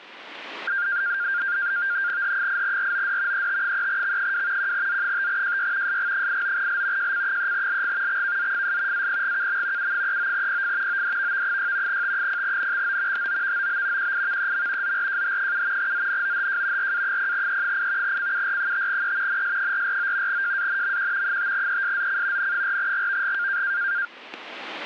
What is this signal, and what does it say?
NAVTEX (SITOR-B), 100 baud, 170 Hz shift, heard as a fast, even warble, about 1500 Hz centre, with static crashes. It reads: H8ROD ET3X2 1Z5JY SG89L JC3LG XKZFS APGKM U39PF ODVV6 T0NXO HOVOB QIVEM ZRJH7 ZNOHJ RA0E8 CUR5E NS449 JANMQ 5ESZC N4GVG